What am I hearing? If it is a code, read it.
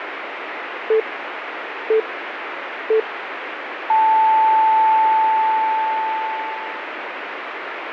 Radio time signal (three low pips and a long one an octave up, as on NHK), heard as pips, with radio static.